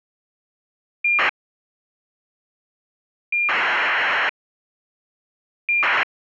ACARS aircraft data, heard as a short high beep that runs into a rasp, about 2400 baud.